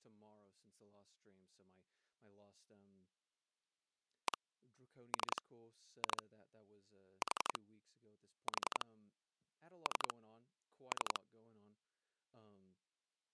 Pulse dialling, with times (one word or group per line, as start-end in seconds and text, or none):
4.3-4.4 1
5.1-5.4 3
6.0-6.2 2
7.2-7.6 4
8.5-8.8 4
9.9-10.1 3
10.9-11.2 3